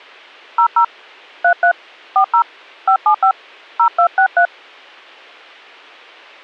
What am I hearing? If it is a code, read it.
DTMF, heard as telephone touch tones, dialled by hand, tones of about 90 ms. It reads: 00 33 40 575 0263